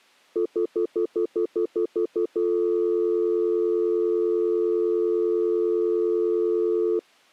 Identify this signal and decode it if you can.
Telephone call progress tone (North American plan), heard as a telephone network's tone, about 350, 440 Hz, 0.1 s on and 0.1 s off. Stutter dial tone.